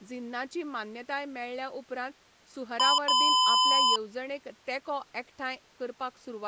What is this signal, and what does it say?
Beep code, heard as beeps from a small speaker, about 1010 Hz, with speech in Goan Konkani. 1 short, 1 long.